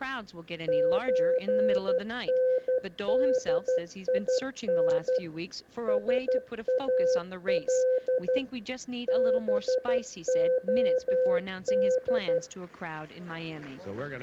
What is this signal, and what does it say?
Morse code (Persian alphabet), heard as a keyed tone, machine-sent, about 12 wpm, 510 Hz. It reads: چندین سال بعد